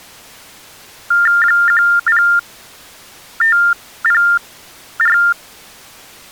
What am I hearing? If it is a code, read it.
TTY/TDD text telephone tones (45.45 baud Baudot), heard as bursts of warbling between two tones, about 400 Hz shift, 1600 Hz centre. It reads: 10504